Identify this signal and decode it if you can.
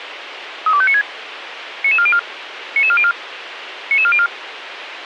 Five-tone selective call (ZVEI), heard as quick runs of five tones, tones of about 70 ms, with radio hiss and a squelch burst at the end. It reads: 32596 99404 99404 99404